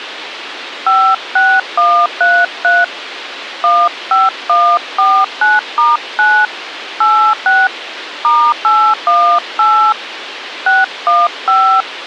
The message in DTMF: 56133 15149*9 86 *818 615

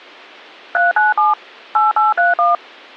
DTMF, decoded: 397 8831

